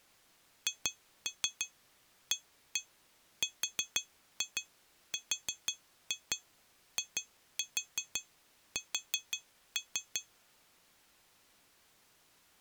Tap code, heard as taps on glass, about 5 knocks a second. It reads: HARRIS